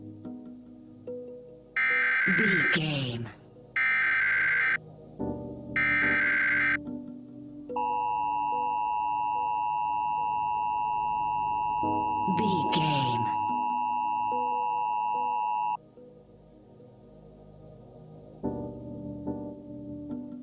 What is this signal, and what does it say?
Emergency Alert System (SAME) tones (header bursts, then the 853 and 960 Hz attention tone), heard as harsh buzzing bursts, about 520.83 baud.